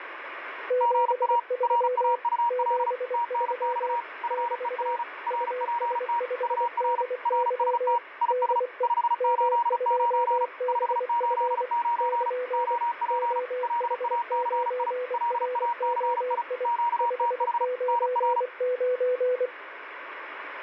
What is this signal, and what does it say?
Morse code, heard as two keyed tones, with radio static. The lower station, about 24 wpm, 500 Hz: 73 73 <BT> US5DY DE M2BF <KN> OH9ROI 599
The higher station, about 35 wpm, 950 Hz: GA RAUL TNX FER RPT UR RST IS 589 589 OP LACI LACI QTH NR